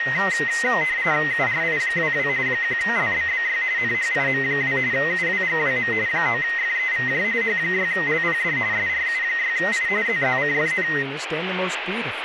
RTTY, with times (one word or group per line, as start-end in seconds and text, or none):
1.3-2.3 URI22
2.5-3.6 1LBBY
3.8-4.8 NHIM2
4.9-5.9 UWGWM
6.1-7.2 9FEVJ
7.4-8.6 H6LPD
8.7-9.9 SRU6I
10.1-10.9 ZZCFN